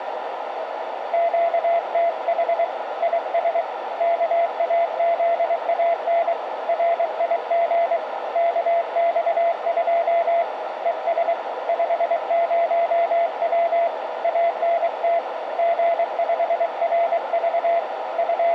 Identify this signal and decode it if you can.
Morse code, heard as a keyed tone, hand-sent with a paddle, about 23 wpm, 680 Hz, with radio static and a narrow filter. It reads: QTH IS KAZAN RIG KX2 ES 50W ANT G5RV …